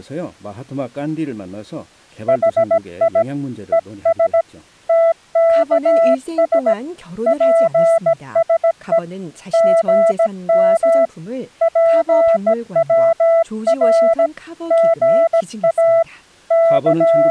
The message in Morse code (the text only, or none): HI ES TKS PSE GM PWR GA …